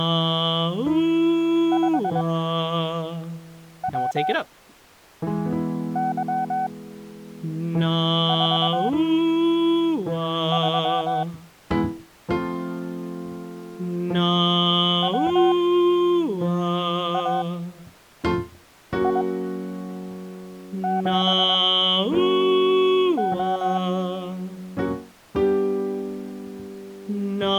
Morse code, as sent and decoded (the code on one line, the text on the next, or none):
..... .-- -.-- ....- ...-- / .-- .- .. --... ---
5WY43 WAI7O